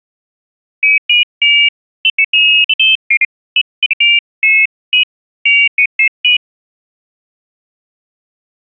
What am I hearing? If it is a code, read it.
Pairs of high tones at irregular times. There is no code.